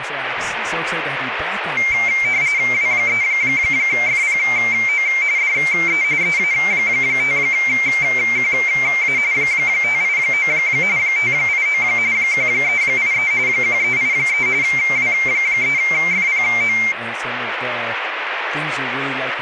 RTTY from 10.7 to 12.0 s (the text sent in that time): 589